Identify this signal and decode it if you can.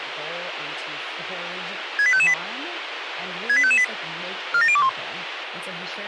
Five-tone selective call (ZVEI), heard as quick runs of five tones, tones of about 70 ms, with radio hiss and speech in English. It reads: 68558 68558 47021